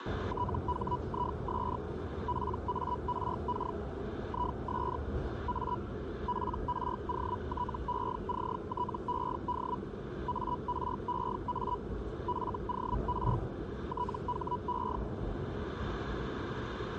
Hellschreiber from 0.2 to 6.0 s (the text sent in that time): THIS PARK IS A